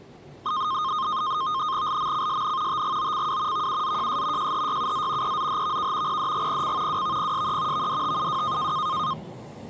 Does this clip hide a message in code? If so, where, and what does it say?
Yes: NAVTEX (SITOR-B), 100 baud, 170 Hz shift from 0.5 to 9.1 s, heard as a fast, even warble, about 1150 Hz centre, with the noise inside a subway train. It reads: LMCSN TGOCW VUZJS JHYUZ EZHVK PDGPC WVPSE VDTUW